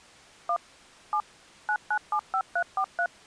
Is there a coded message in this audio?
Yes: DTMF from 0.5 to 3.1 s, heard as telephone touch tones, dialled by machine, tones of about 70 ms. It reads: 1 7 9975343